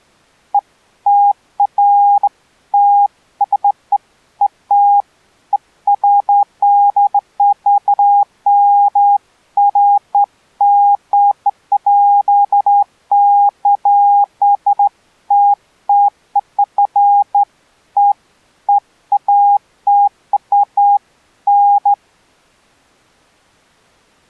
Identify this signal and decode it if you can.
Beeps of irregular length. There is no code.